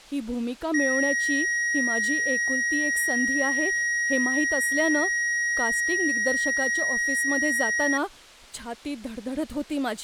A steady tone, with speech in Marathi. There is no code.